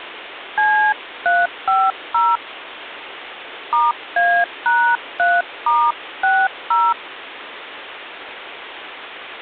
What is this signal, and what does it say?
DTMF, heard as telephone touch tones, dialled by hand, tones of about 260 ms, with phone line noise. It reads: C350 *A#3*60